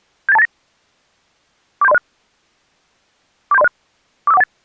Five-tone selective call (EIA), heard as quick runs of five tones, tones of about 30 ms. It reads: 78289 47306 47306 45418